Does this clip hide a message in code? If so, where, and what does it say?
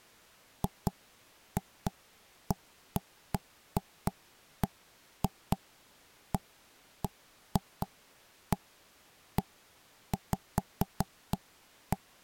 No, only irregular knocks on wood.